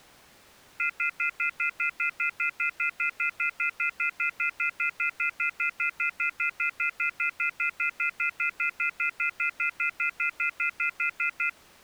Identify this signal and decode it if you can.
Telephone call progress tone (North American plan), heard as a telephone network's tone, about 1400, 2050, 2450, 2600 Hz, 0.1 s on and 0.1 s off. Off-hook warning tone.